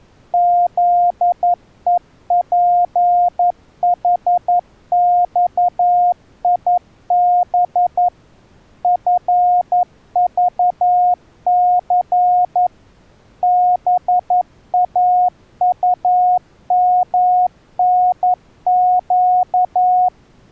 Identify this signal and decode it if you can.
Morse code, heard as a keyed tone, machine-sent, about 11 wpm, 720 Hz. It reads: ZEPHXIB FVC BAUMNQ